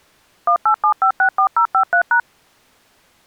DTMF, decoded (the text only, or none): 187564053#